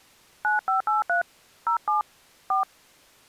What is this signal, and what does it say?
DTMF, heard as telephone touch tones, dialled by hand, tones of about 120 ms. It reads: 9583 07 4